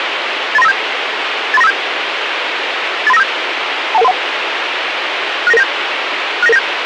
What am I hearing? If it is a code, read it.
Five-tone selective call (EIA), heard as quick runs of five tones, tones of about 30 ms, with radio hiss. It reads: 83957 83957 83957 21131 69997 69997